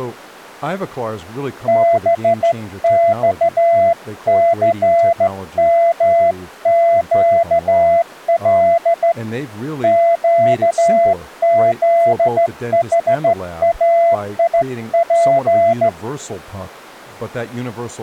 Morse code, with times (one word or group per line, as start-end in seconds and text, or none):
1.7-9.1 BXCMQL
9.8-15.9 QZHAIP